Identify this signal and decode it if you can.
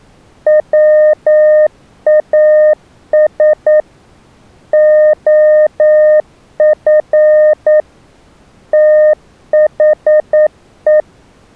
Morse code, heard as a keyed tone, machine-sent, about 9 wpm, 610 Hz. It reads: WAS OF THE